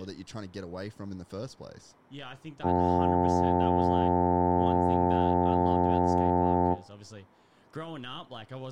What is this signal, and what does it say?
Ship horn signal, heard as a ship's horn, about 90 Hz, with room echo and speech in English. 1 long. At sea: a vessel nearing a blind bend, or under power and making way in fog.